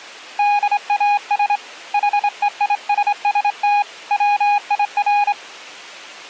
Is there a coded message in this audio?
Yes: Morse code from 0.3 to 5.4 s, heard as a keyed tone, hand-sent with a straight key, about 25 wpm, 820 Hz. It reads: DAS HEISST WIR